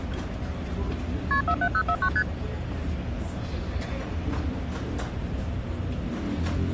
Multi-frequency trunk signalling (R1, as on North American trunks), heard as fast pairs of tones, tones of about 70 ms, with the noise of a restaurant. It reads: KP 47049 ST